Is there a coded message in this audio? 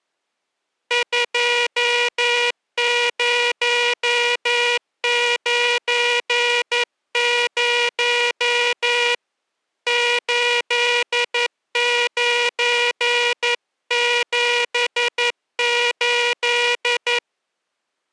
Yes: Morse code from 0.8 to 17.2 s, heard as a buzzer, hand-sent with a paddle, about 11 wpm. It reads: 2090 8978